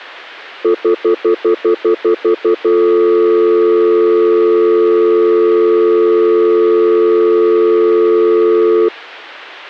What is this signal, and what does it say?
Telephone call progress tone (North American plan), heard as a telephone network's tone, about 350, 440 Hz, 0.1 s on and 0.1 s off. Stutter dial tone.